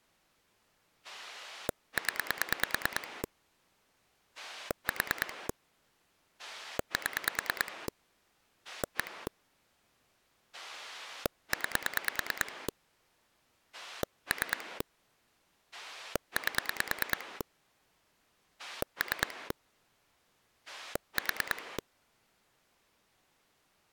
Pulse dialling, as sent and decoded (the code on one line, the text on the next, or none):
10 / 4 / 7 / 1 / 9 / 3 / 8 / 3 / 4
0 4 7 1 9 3 8 3 4